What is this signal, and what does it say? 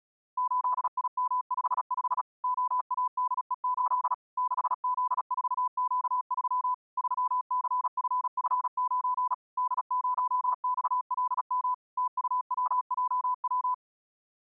Morse code, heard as a keyed tone, machine-sent, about 36 wpm, 1000 Hz. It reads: 8IM55 OADE8 6Z4Q3 3CFF9 D0XLM TUWJW